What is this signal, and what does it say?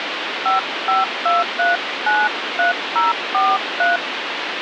DTMF, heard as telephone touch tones, dialled by hand, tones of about 180 ms, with phone line noise. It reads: 552393043